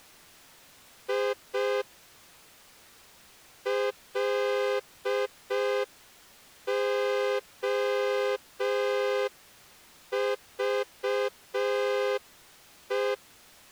Morse code, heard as a horn, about 5 wpm. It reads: I LOVE